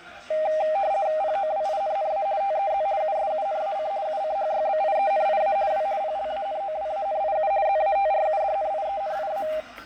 RTTY (50 baud, 170 Hz shift), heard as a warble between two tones, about 710 Hz centre, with fading, static crashes and the noise of a cafe. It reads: POWINNA TEZ USUNAC UCHYBIENIA W PLANOWANIU ZATRUDNIENIA